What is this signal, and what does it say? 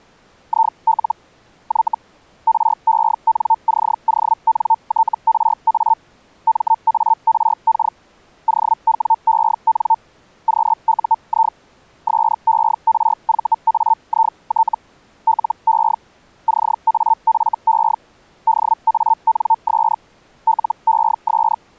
Hellschreiber (Feld-Hell, 122.5 baud), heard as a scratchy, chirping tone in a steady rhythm, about 900 Hz. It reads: IL Y RENCONTRA MARK OWEN QUI SERVAIT LE CAFE DANS LES